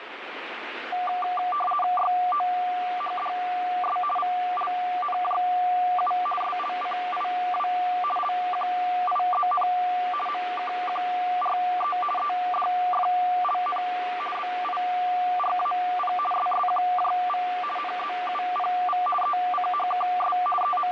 RTTY (50 baud, 450 Hz shift), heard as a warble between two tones, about 950 Hz centre, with radio static. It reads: YOHDS VLNJU SLCIW LQIZN MKQRE EDFLN BIRAP SSQJV NZUPV ECHKS …